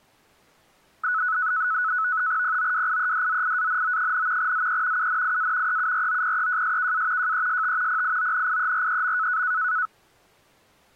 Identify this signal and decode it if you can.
NAVTEX (SITOR-B), 100 baud, 170 Hz shift, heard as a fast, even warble, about 1380 Hz centre. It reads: POWIEDZIANO, ZE UNIA EUROPEJSKA JEST PIONIEREM